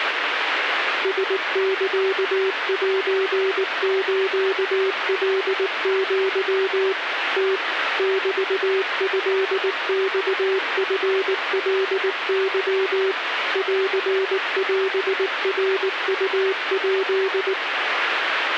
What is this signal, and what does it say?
Morse code (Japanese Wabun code), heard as a keyed tone, machine-sent, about 19 wpm, 380 Hz, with radio static. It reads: ラサセスカア ム メトマチカケ ンオナウヱ